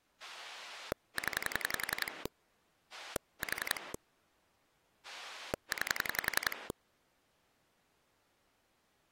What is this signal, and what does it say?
Pulse dialling, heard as a rotary dial, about 11 pulses a second. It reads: 0 4 9